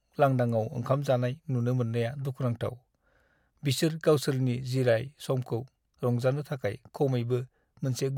Speech in Bodo. There is no code.